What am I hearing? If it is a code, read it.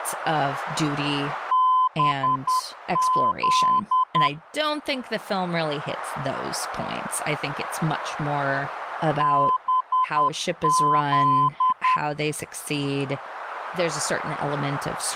Morse code, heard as a keyed tone, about 10 wpm, 1020 Hz, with speech in English. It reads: BZ BZ